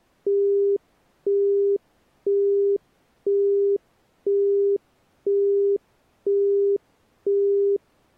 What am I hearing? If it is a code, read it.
Telephone call progress tone (single-tone plan, as in Europe, Japan and elsewhere), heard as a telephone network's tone, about 400 Hz, 0.5 s on and 0.5 s off. Busy tone.